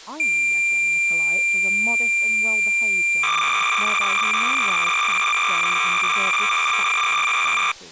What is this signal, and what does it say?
Cassette data (Kansas City type), 300 baud, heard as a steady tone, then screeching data, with speech in English.